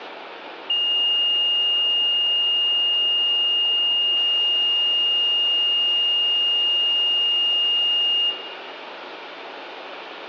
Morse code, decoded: none

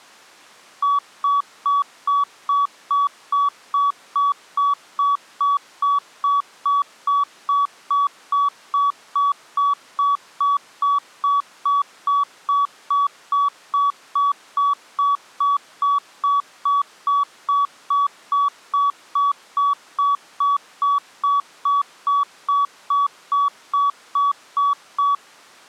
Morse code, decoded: none

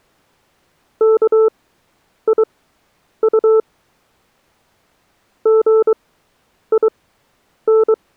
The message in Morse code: KIU GIN

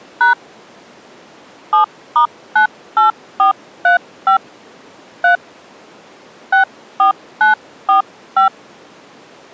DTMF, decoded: # 7*98435 3 64945

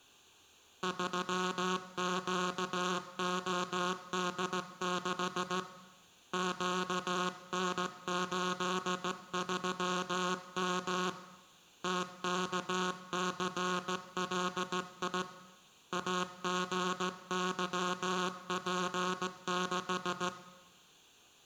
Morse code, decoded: 3QOD6 QN83M TKCLI AGYP6

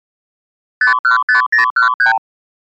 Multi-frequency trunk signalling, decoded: 515013

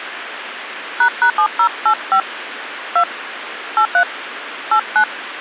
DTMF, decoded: ##7085 2 83 89

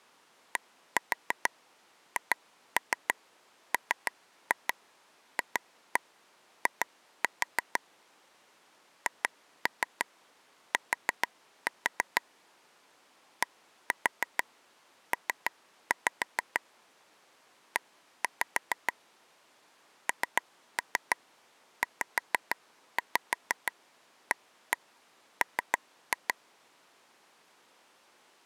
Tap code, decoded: DHMFI HT DP E NZAM

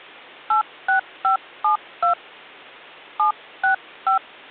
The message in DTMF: 86572 765

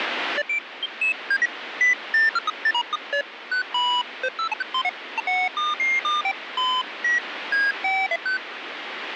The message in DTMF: none

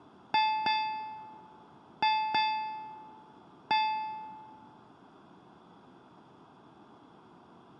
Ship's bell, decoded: 5

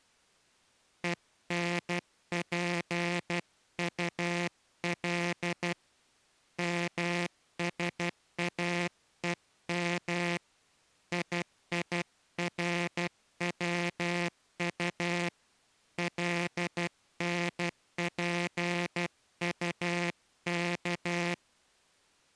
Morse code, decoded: ENPUL MSAEM IIRWU LNPUK

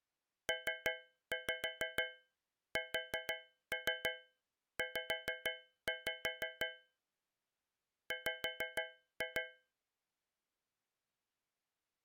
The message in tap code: PSZ W

